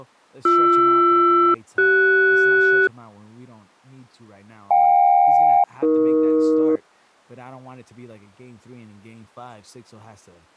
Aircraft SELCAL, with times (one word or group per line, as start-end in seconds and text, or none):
0.5-2.9 BR-CS
4.7-6.8 JK-AE